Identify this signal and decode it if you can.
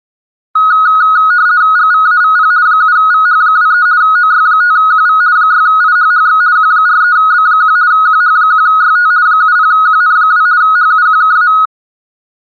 RTTY (50 baud, 170 Hz shift), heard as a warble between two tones, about 1360 Hz centre. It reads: GVAVP 7VH23 OY5QV 6IHHX Q43B1 QH1YT 70QN2 HUQKA